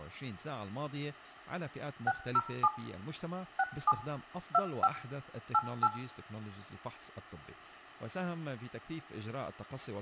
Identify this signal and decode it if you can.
DTMF, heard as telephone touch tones, dialled by machine, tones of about 50 ms, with room echo and speech in Arabic. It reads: 607 67 25 88